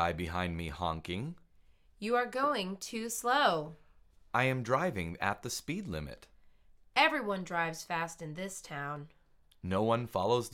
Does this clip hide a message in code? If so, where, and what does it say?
No.